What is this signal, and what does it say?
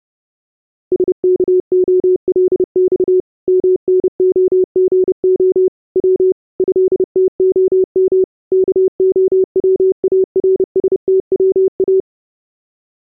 Morse code (Russian alphabet), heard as a keyed tone, machine-sent, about 30 wpm, 370 Hz. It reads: СКОЛЬ МНОГО В ЭТОМ КОВАРСТВА